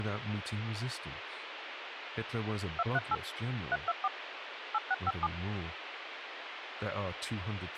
DTMF, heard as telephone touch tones, dialled by machine, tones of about 40 ms, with radio hiss and speech in English. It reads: 238 324 8657